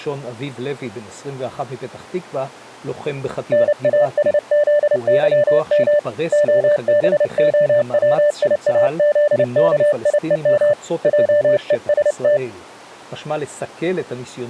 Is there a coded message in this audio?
Yes: Morse code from 3.5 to 12.4 s, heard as a keyed tone, hand-sent with a paddle, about 29 wpm, 590 Hz. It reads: NASZYM OBOWIAZKIEM JEST